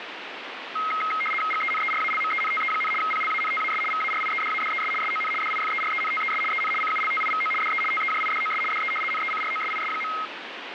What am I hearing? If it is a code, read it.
RTTY (75 baud, 850 Hz shift), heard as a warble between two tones, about 1700 Hz centre, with radio static. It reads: GENERALMENTE, PLANTAS VARIEDADES SON DIFERENTES EN CULTIVO DE TEJIDOS DE NECROSIS.